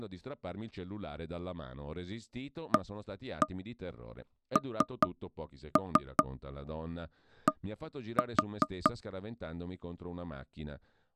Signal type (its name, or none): tap code